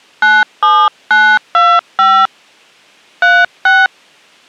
DTMF, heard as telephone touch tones, dialled by hand, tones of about 260 ms. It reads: 97925 36